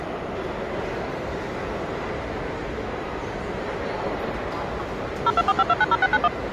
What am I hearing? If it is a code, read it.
DTMF, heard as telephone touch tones, dialled by machine, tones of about 40 ms, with the noise of a crowd indoors. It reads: 0245290691